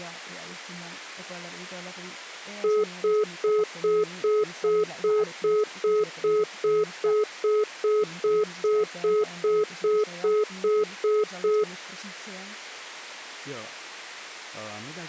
Telephone call progress tone (single-tone plan, as in most of Europe), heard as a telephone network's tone, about 420 Hz, 0.2 s on and 0.2 s off, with speech in Finnish. Congestion tone.